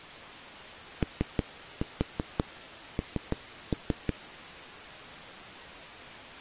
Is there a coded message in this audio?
Yes: tap code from 1.0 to 4.1 s, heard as knocks on a wall, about 6 knocks a second. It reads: ON